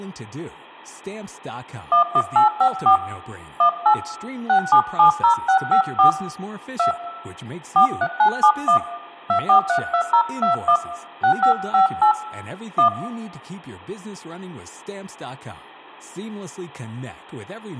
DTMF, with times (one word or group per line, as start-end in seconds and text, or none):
1.9-3.0 11854
3.6-3.9 18
4.5-6.1 6770654
6.8-6.9 2
7.8-8.8 43971
9.3-10.8 2432021
11.2-12.1 6558
12.8-12.9 1